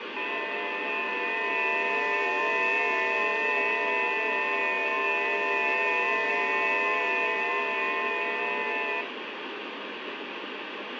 FT8 (several signals at once), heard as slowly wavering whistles, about 6.25 baud, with heavy radio static.